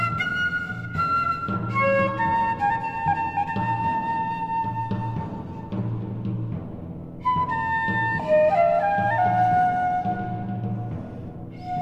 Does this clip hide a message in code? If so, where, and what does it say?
No.